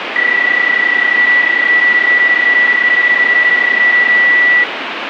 PSK31 (31.25 baud), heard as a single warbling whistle, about 1950 Hz, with radio static.